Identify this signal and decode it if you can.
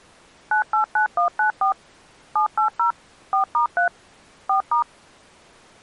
DTMF, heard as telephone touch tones, dialled by machine, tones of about 110 ms. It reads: 989194 780 4*3 4*